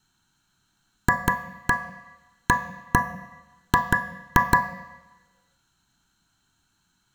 Tap code, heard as taps on a metal pipe, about 6 knocks a second, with room echo. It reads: FAG